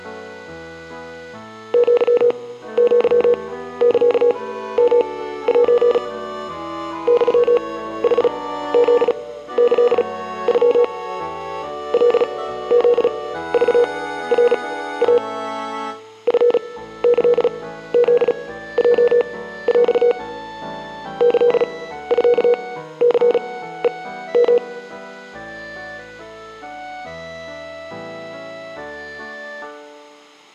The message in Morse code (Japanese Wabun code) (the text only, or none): アアサヨセ ユヌフキノ カフクナイ チキフヲヰ キミニヘヨ